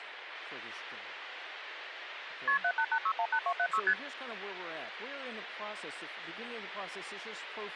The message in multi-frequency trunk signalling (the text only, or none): KP 788618276 ST